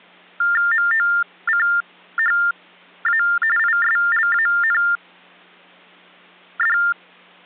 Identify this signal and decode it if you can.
TTY/TDD text telephone tones (45.45 baud Baudot), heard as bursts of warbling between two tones, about 400 Hz shift, 1600 Hz centre. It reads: MOCHA ISLAND